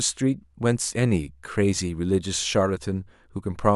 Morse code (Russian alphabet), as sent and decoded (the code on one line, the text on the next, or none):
none